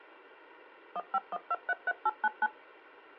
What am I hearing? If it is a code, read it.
DTMF, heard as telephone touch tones, dialled by machine, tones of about 40 ms. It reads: 151233899